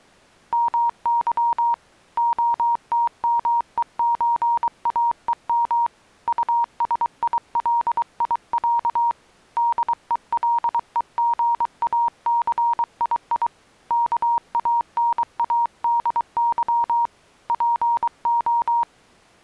Morse code (Russian alphabet), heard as a keyed tone, hand-sent with a paddle, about 23 wpm, 940 Hz. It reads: МЫ ОТМЕЧАЕМ УСИЛИЯ ДЕЛЕГАЦИИ КАНАДЫ ПО